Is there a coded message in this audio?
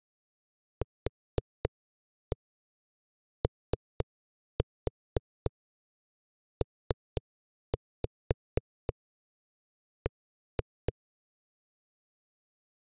Yes: tap code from 0.8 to 10.9 s, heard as knocks on a wall, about 4 knocks a second. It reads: QOPB